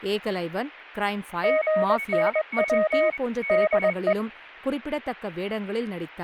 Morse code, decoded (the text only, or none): GNW DE